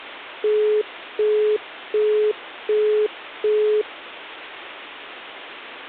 Telephone call progress tone (as in the UK, Australia and similar networks), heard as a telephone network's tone, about 420 Hz, 0.375 s on and 0.375 s off. Busy tone.